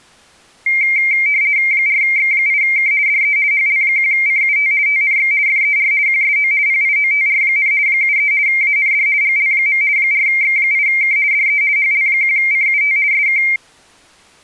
RTTY (50 baud, 170 Hz shift), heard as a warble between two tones, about 2200 Hz centre. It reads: 4X8K DE HL1CUT TNX FER QSO PIOTR, 73 AND GL. 4X8K DE HL1CUT SK